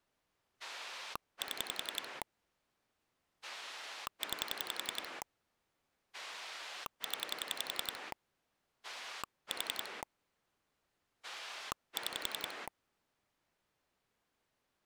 Pulse dialling, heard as a rotary dial, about 11 pulses a second. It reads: 7 9 0 4 6